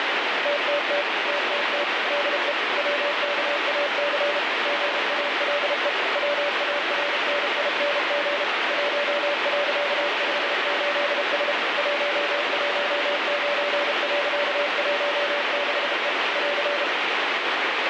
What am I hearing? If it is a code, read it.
Morse code, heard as a keyed tone, machine-sent, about 32 wpm, 580 Hz, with heavy radio static. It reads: TTT TTT DE WKAC GALE WARNING 1.58S 119.16E <AR>